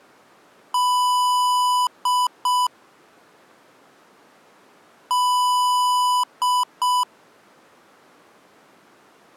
Beep code, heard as beeps from a small speaker, played twice, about 990 Hz. 1 long, 2 short. In Award, IBM and AMI BIOS tables: video adapter failure.